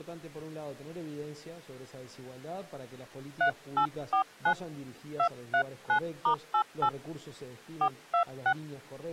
DTMF, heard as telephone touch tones, dialled by hand, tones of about 90 ms. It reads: 3849 239*88 426